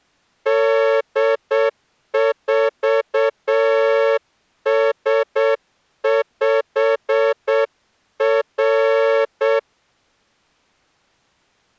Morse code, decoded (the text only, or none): D4S5R